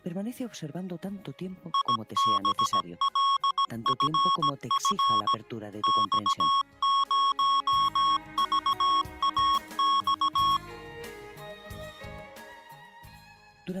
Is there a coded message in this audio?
Yes: Morse code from 1.7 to 10.6 s, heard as electronic beeps, machine-sent, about 17 wpm, 1100 Hz. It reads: IBLFF X0VAX